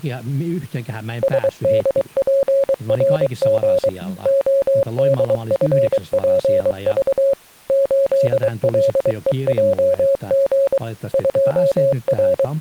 Morse code, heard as a keyed tone, machine-sent, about 23 wpm, 550 Hz, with speech in Finnish. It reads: SDPRG ODFPV 8LEJG …